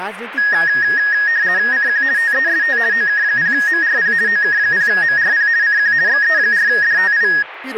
RTTY (50 baud, 170 Hz shift), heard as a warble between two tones, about 1750 Hz centre, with radio static and speech in Nepali. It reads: CQ TEST OK0MRP OK0MRP CQ XE4DTI